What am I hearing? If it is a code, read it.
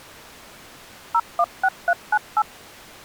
DTMF, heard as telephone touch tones, dialled by machine, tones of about 60 ms. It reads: 016398